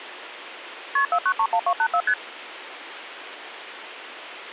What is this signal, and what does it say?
Multi-frequency trunk signalling (R1, as on North American trunks), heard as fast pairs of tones, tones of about 70 ms, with phone line noise. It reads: KP 4931284 ST